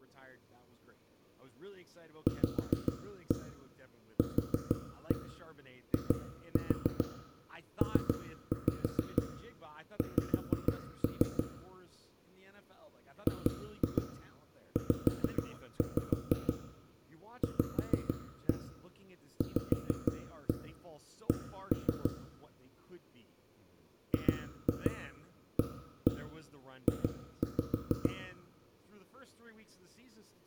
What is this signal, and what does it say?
Tap code, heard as knocks on wood, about 6 knocks a second, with room echo and speech in English. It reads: VQIPX GZVVC GAJ